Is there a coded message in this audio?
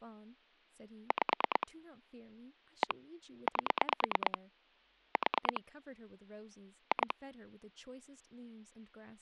Yes: pulse dialling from 1.1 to 7.1 s, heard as clicks on a phone line, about 9 pulses a second, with speech in English. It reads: 5 1 8 4 2